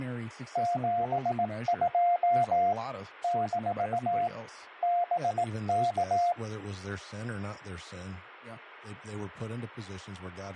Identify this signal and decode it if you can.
Morse code, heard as a keyed tone, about 18 wpm, 700 Hz, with speech in English. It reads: 72 - BK